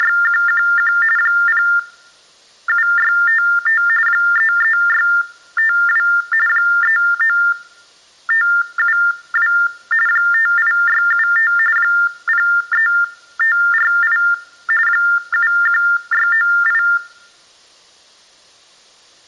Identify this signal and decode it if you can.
TTY/TDD text telephone tones (45.45 baud Baudot), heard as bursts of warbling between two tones, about 400 Hz shift, 1600 Hz centre. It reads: … 07655 33652 39572 58675 03548 71698